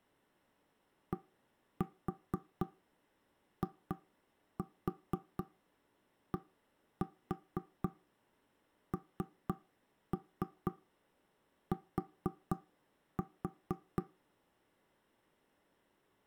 Tap code, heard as knocks on wood, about 4 knocks a second. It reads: DIDNT